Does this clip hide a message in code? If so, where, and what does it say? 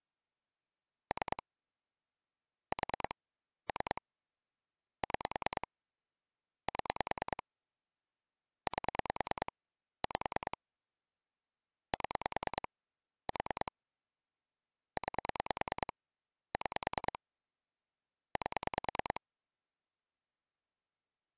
Yes: pulse dialling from 1.1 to 19.2 s, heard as clicks on a phone line, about 9 pulses a second. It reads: 3 4 3 6 7 8 5 7 4 9 6 8